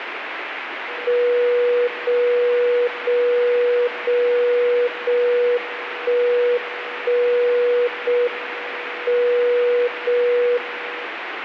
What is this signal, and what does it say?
Radio time signal (JJY), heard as a tone whose level steps once a second, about 490 Hz, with radio static. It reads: 0 0 0 0 1 1 0 M 0 1